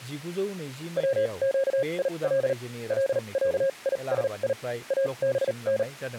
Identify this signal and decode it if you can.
Morse code (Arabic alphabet), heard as a keyed tone, machine-sent, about 38 wpm, spaced as for 30 wpm, 540 Hz, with speech in Bodo. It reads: وقيل لعيسي ابن